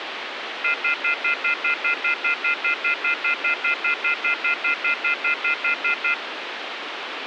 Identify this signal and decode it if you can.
Telephone call progress tone (North American plan), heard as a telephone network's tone, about 1400, 2050, 2450, 2600 Hz, 0.1 s on and 0.1 s off, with phone line noise. Off-hook warning tone.